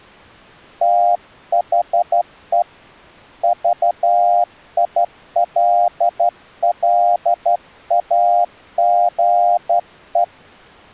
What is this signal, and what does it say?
Morse code, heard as a keyed tone, hand-sent with a straight key, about 12 wpm, 700 Hz. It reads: THE VILLAGE